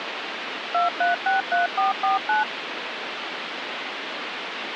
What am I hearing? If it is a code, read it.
DTMF, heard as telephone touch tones, dialled by machine, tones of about 140 ms, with phone line noise. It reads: 2363449